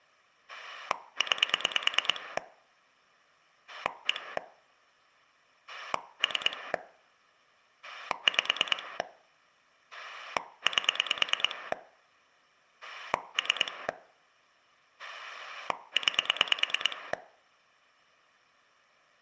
Pulse dialling, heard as a rotary dial, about 9 pulses a second. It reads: 9 1 3 5 8 3 9